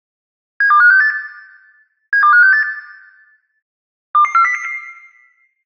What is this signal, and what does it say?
Five-tone selective call (CCIR), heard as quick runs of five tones, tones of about 100 ms, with room echo. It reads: 72568 72568 22400